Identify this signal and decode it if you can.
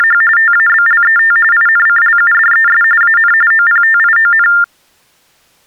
TTY/TDD text telephone tones (45.45 baud Baudot), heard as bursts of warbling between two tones, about 400 Hz shift, 1600 Hz centre. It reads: … TABLET INCLUDES AN OPTION